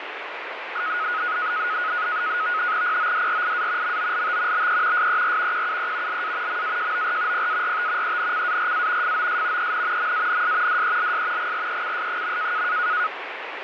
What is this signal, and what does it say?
NAVTEX (SITOR-B), 100 baud, 170 Hz shift, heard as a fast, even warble, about 1360 Hz centre, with radio static. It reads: PODRIA MOLT BE SER QUE LA MAJOR PART ENCARA FOS EN MANS DELS GRECS.